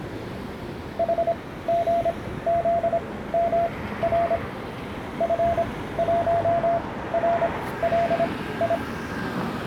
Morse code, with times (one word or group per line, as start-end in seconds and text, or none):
1.0-4.4 HGZMR
5.2-8.7 F1RLI